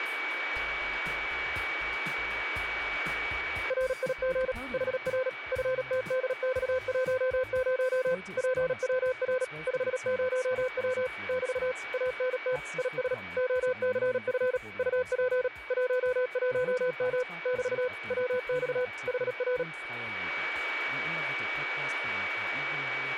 Morse code, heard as a keyed tone, machine-sent, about 37 wpm, 510 Hz, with radio static and a steady whistle near 2270 Hz. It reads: RIG HR FTDX10 PWR 50W <BT> ANT IS OCF UP 11M <BT> WX HR